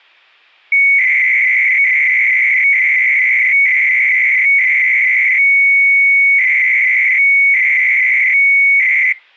300-baud modem data (Bell 103 tones), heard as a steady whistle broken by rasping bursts, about 300 baud, 200 Hz shift.